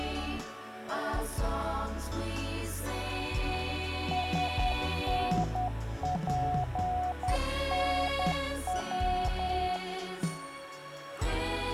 Morse code, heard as a keyed tone, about 10 wpm, 730 Hz. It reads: SNPNW